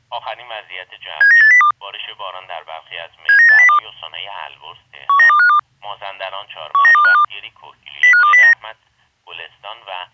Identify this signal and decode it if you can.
Five-tone selective call (CCIR), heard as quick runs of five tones, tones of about 100 ms. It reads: 79802 79802 19252 19252 05209